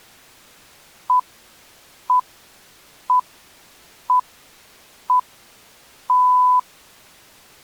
Radio time signal (six pips, as the Greenwich Time Signal), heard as pips.